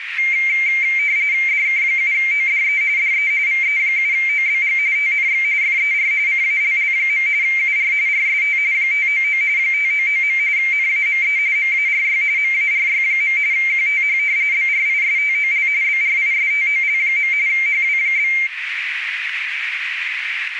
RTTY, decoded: DK7ODE DE VE7OBG TNX FER CALL. UR RST 599 599. NAME MARY MARY. QTH BRISTOL BRISTOL. HW?

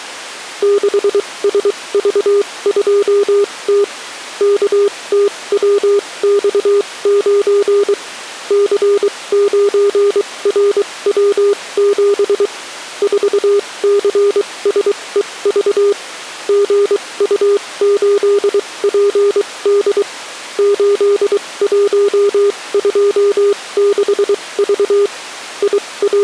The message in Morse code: 6SV2T KTWX9 C9RW7 4CSEV GU8PD 8126V …

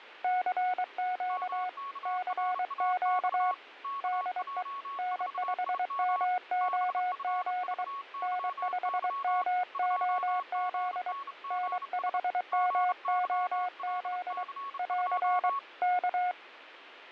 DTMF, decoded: none

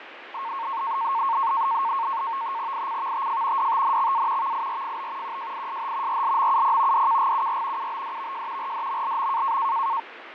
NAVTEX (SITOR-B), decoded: ICVTF DTNXA VIRFB QJISH RLMUP DKGUR UBDVJ RDMLM

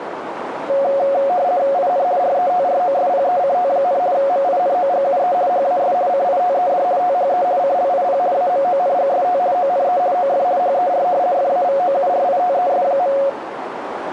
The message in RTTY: IN RETROSPECT, MINOGUE HAS CITED THE CLIP AMONGST ONE OF HER FAVOURITES.

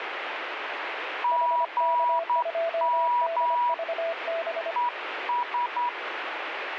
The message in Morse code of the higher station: GM ES

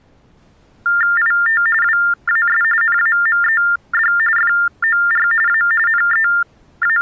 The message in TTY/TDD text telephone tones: IT WAS NAMED FOR A …

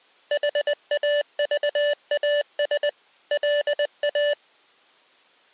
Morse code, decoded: HAVAS LA

